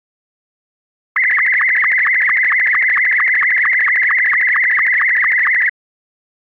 SSTV (slow-scan television), Martin M2, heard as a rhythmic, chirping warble.